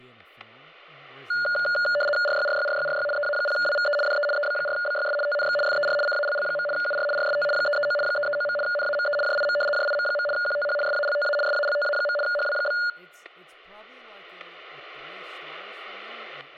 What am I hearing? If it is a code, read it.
RTTY (75 baud, 850 Hz shift), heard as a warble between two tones, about 1010 Hz centre, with static crashes and speech in English. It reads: RYRYRYRY EA0WVE DE EB4BYS TNX FER CALL. UR RST 339 339. NAME JIM JIM. QTH SALTA SALTA. HW?